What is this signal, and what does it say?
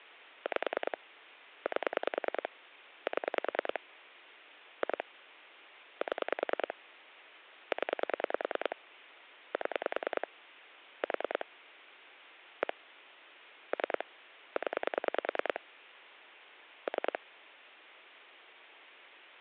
Pulse dialling, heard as clicks on a phone line, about 10 pulses a second. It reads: 5 8 7 2 7 0 7 4 1 3 0 3